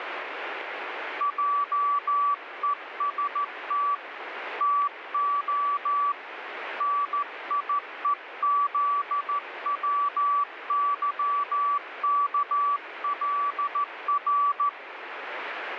Morse code, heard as a keyed tone, hand-sent with a straight key, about 14 wpm, 1150 Hz, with radio static. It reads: JEST TO NIEZWYKLR